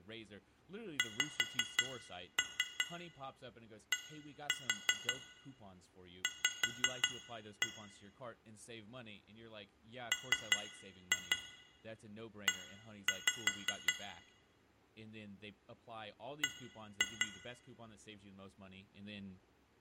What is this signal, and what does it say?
Tap code, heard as taps on glass, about 5 knocks a second, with room echo and speech in English. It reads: XDV ME B